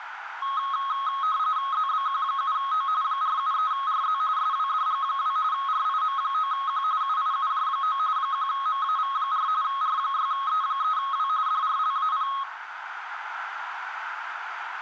RTTY (45.45 baud, 170 Hz shift), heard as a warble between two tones, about 1180 Hz centre, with radio static, a narrow filter and room echo. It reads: ZBQ7O 473RZ SWDG2 RIM9Q UIUJ9 1MAV4 R6E3W DRLAP